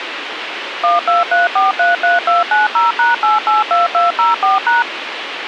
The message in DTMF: 123433290#882204#

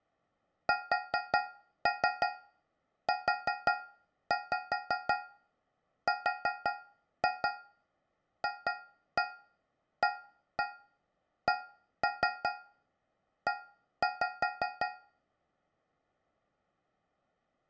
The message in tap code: SURFACE

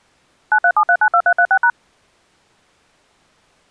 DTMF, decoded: 937392336#

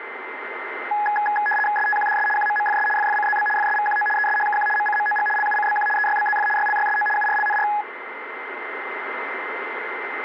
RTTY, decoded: STQDS QMMFS FFCZB FSVQO ESHKQ MCMOG LUCBQ EYBZF YLYSO URLNR

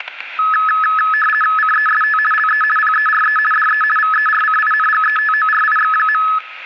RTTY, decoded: CEST LE PERE DE VERCINGETORIX.

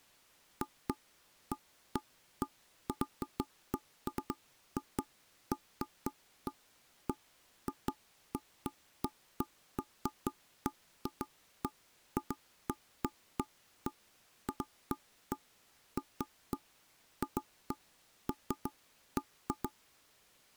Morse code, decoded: none

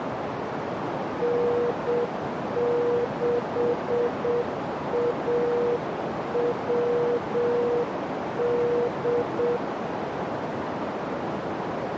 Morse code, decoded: N6AWD

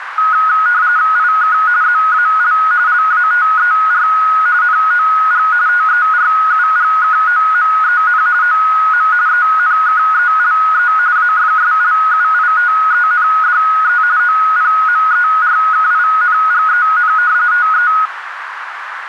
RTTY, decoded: IK ZAL LATER NOG TERUGKOMEN OM ENKELE AFSLUITENDE OPMERKINGEN TE

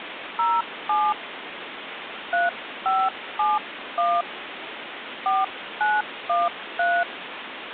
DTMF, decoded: 07 3571 4913

